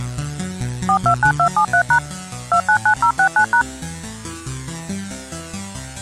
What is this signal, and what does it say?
DTMF, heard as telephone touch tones, dialled by machine, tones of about 80 ms. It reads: 429273# 299069#